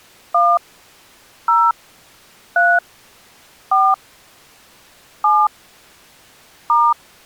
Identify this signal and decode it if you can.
DTMF, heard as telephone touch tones, dialled by hand, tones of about 230 ms. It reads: 1 0 3 4 7 *